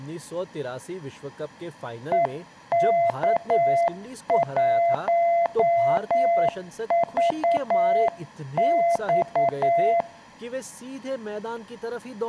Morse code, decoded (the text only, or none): EK1VX